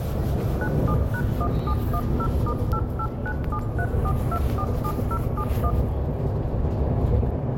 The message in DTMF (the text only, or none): 97#1710*889734247071